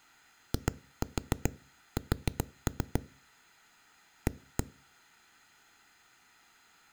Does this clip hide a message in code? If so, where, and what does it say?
Yes: tap code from 0.5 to 4.6 s, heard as knocks on a wall, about 7 knocks a second. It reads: IS A